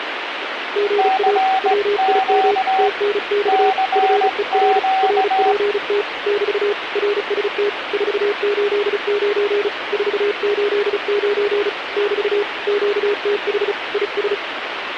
Morse code, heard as two keyed tones, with radio static. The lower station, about 35 wpm, 410 Hz: GA WIM TNX FER RPT <BT> RST 489 489 <BT> QTH IS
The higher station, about 18 wpm, 760 Hz: CQ CQ